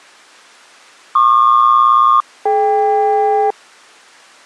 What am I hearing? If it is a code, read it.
Aircraft SELCAL, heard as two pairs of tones. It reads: PQ-DK